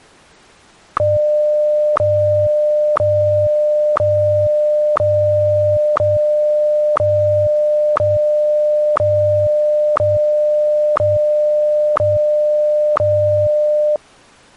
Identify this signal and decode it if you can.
Radio time signal (WWVH, Hawaii), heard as ticks, one a second.